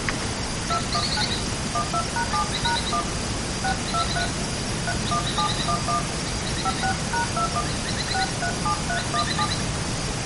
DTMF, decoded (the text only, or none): 219 12#7#1 623 31711 56#21 637317